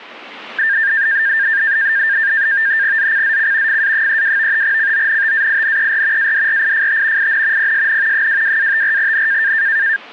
NAVTEX (SITOR-B), 100 baud, 170 Hz shift, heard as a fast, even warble, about 1700 Hz centre. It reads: ZCZC FA32 CONTAINER ADRIFT IN PSN 22-54N